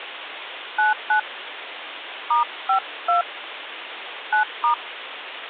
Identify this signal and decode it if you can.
DTMF, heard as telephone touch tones, dialled by hand, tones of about 120 ms, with phone line noise. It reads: 99 *52 9*